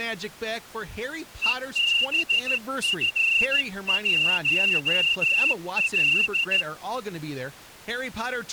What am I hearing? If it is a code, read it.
Morse code, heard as a whistle, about 14 wpm, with speech in English. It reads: EBF1L